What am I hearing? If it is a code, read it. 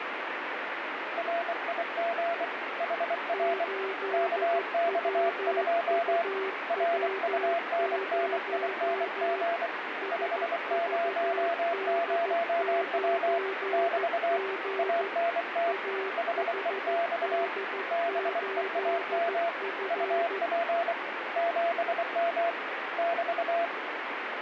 Morse code, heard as two keyed tones, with radio static. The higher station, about 24 wpm, 680 Hz: RIG HR KX2 RUNNING 500W <BT> ANT HEX BEAM UP 7M <BT>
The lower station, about 14 wpm, 390 Hz: 8WUW0 SVD9G AHD8F